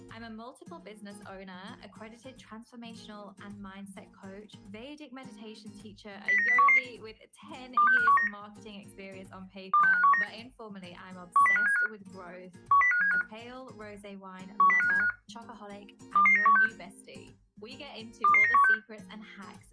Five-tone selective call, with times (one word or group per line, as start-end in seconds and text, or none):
6.3-6.8 09011
7.8-8.3 26519
9.7-10.2 26519
11.4-11.9 10575
12.7-13.2 10575
14.6-15.1 10575
16.2-16.7 22916
18.2-18.7 22916